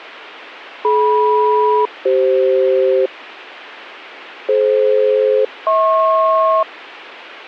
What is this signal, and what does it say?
Aircraft SELCAL, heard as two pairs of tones. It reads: DM-CF DF-HP